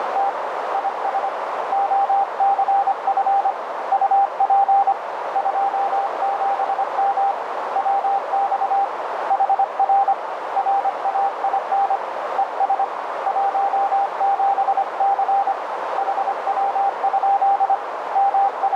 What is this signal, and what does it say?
Morse code, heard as a keyed tone, hand-sent with a paddle, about 25 wpm, 790 Hz, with heavy radio static and a narrow filter. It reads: … IS OCF UP 27M WX HR RAIN ES 17C HW? …